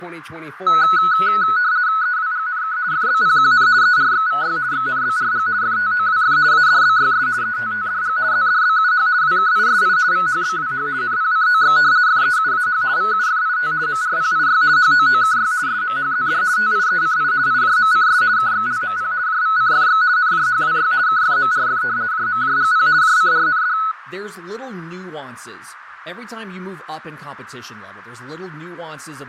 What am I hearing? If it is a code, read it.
RTTY (50 baud, 170 Hz shift), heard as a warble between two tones, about 1380 Hz centre, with radio static, fading, a narrow filter and speech in English. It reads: EWGNK FBPQN ERXVY XNBRG FTOWF ADBYS ETTDG ZDBUH WKISI VHBWH NPCOX FEUAH VUFIT MRPIY HOOKY SMHZD TIECI IJMCS KXLMP JVCFX NJHWY KFMRF JMJGP JCRND